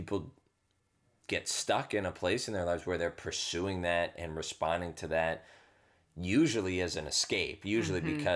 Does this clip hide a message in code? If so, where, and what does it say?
No, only speech in English.